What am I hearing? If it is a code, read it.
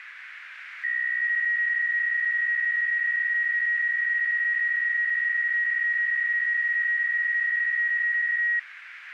PSK63 (62.5 baud), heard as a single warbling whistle, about 1900 Hz, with radio static.